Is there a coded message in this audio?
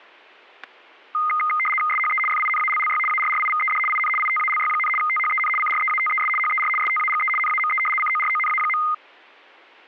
Yes: RTTY (75 baud, 850 Hz shift) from 1.1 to 8.9 s, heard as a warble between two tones, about 1650 Hz centre, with static crashes. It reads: SHE FINALLY ARRIVED IN ITALY, THEN CREATES HER STAGE NAME CORONA.